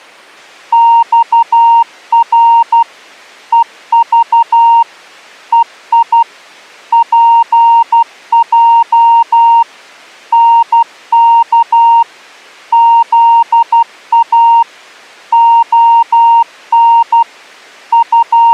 Morse code, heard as a keyed tone, machine-sent, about 12 wpm, 930 Hz. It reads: XR EV EI PJ NK ZA ON …